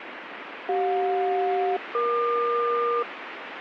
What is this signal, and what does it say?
Aircraft SELCAL, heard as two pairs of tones, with radio static. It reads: CJ-EQ